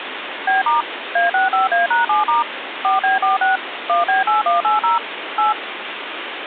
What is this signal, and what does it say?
DTMF, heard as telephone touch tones, dialled by machine, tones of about 150 ms, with phone line noise. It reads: B* A65A#7* 4B46 1B8180 8